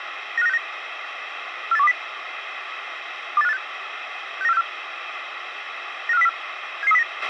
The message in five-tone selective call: 95969 48120 28586 69464 95404 77309

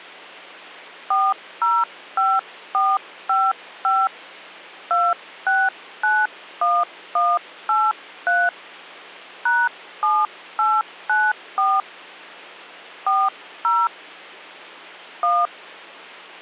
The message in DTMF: 405455 2691183 #7894 40 1

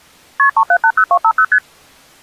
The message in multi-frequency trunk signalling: KP 3780250 ST

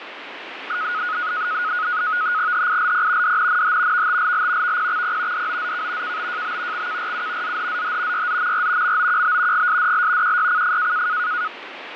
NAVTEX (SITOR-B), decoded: HILP DNNH VTLL VPXP DOZK KBJB XKRU ZHZH YZMR MOQB GSDL QYCF

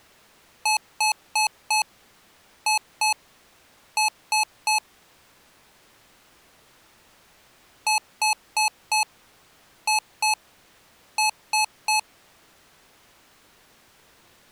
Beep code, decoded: 4-2-3

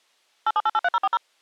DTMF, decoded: 87883040

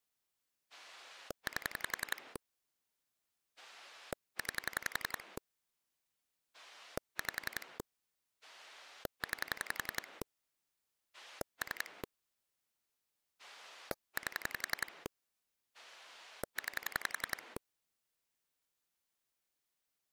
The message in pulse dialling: 8 9 5 9 3 8 9

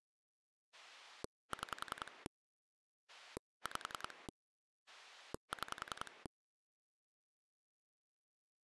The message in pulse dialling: 6 5 6

